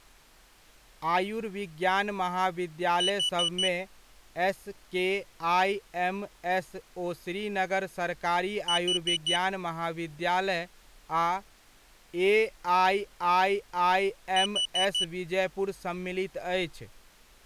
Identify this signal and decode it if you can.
Alarm pattern, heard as an alarm's beeps, played three times, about 2950 Hz, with speech in Maithili. Temporal four. Carbon monoxide.